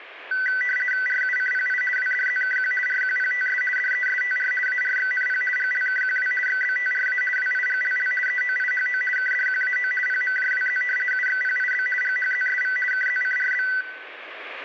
RTTY (50 baud, 450 Hz shift), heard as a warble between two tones, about 1750 Hz centre, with room echo. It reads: RUCPI WDZKQ RQPTS DESTR ARXNP GLKQW XBTRA WIGLL EOIHO KDQAO PMJWZ UXPIB GHZSV KZCRB